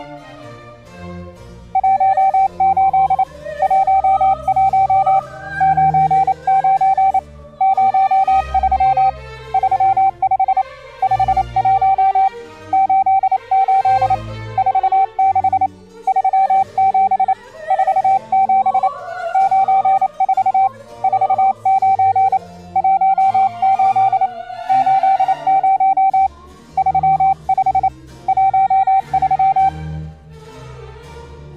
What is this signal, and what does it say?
Morse code, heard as a keyed tone, hand-sent with a paddle, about 28 wpm, 780 Hz. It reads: 18 11 99 03 35 51 88 46 37 47 94 49 18 80 35 13